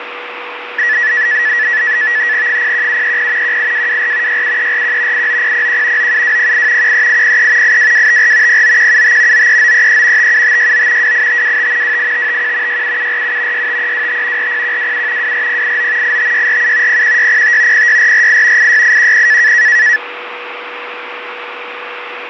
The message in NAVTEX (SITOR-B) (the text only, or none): 01730 18224 67341 89001 97208 13803 82254 09175 93933 57569 28525 28551 67747 65325 40127 24089 85647 01605 06448 86810